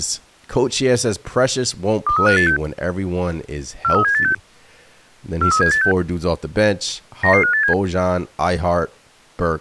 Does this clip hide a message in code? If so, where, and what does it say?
Yes: five-tone selective call (CCIR) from 2.1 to 7.7 s, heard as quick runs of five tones, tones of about 100 ms, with speech in English. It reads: 23586 43786 43786 99587